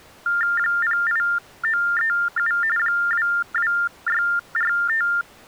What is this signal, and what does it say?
TTY/TDD text telephone tones (45.45 baud Baudot), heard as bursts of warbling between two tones, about 400 Hz shift, 1600 Hz centre. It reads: 08937 22645